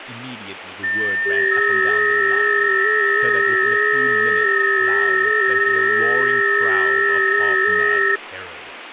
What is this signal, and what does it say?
FT8 (several signals at once), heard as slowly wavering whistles, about 6.25 baud, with radio static and speech in English.